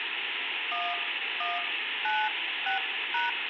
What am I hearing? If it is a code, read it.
DTMF, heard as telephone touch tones, dialled by hand, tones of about 170 ms, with phone line noise. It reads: 1196#